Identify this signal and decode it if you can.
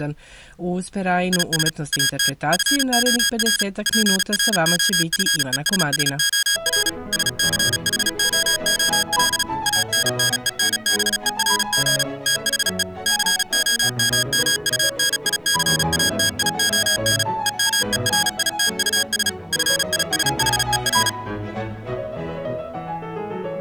Morse code, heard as electronic beeps, machine-sent, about 36 wpm, 1650 Hz. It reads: IS AT FOR PROFESSOR SCHOOL ANNENBERG THE COMMUNICATION EMERITUS FISHER